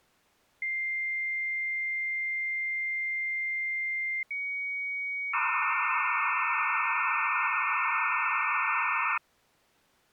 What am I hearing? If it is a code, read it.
Dial-up modem handshake (low-speed, two carriers), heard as two whistles, then hiss.